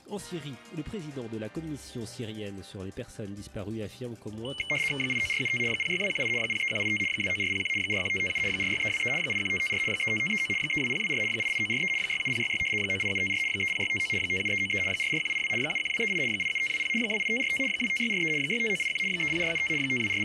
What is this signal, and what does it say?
RTTY (75 baud, 850 Hz shift), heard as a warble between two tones, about 2550 Hz centre. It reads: 89475 06218 03185 29401 41557 46323 81554 35539 32024 88943 67066 98754 30659 57393 44182 71238 87520 28545 25643 65981 30475 …